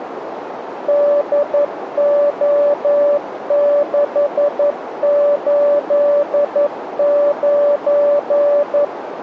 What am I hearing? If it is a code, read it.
Morse code, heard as a keyed tone, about 11 wpm, 580 Hz, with radio static and a narrow filter. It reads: DO689